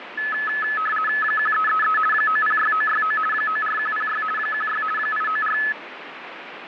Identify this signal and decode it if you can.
RTTY (50 baud, 450 Hz shift), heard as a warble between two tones, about 1500 Hz centre, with radio static. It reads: 1333 906969 94106 16 894